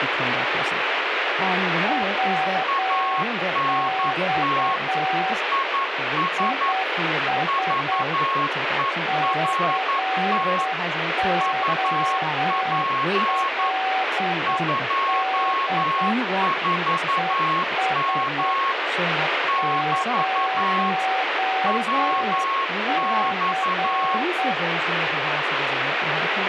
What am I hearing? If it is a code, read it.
Morse code, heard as two keyed tones, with radio static and speech in English. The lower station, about 8 wpm, 760 Hz: WX IS COLD ES 0C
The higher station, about 11 wpm, 1090 Hz: ANT IS VERT UP 24M <BT> WX